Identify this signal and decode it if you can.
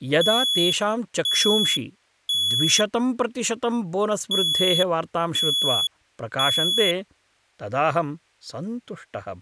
Alarm pattern, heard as an alarm's beeps, played twice, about 3400 Hz, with speech in Sanskrit. Temporal three. Smoke or fire, evacuate.